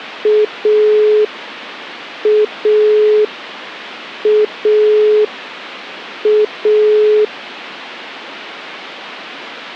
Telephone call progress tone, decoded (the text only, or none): dial tone